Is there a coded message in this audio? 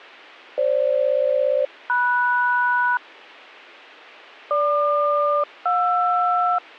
Yes: aircraft SELCAL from 0.6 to 6.6 s, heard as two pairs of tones. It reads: FG-MS GQ-JR